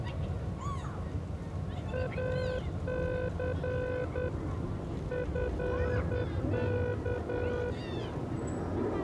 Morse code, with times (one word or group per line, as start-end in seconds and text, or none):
1.9-4.3 AC
5.1-7.7 FK